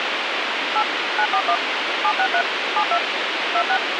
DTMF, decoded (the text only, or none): 8 941 763 72 26